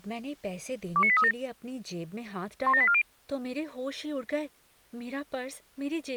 Five-tone selective call (ZVEI), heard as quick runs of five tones, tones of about 70 ms, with speech in Hindi. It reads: 29837 17840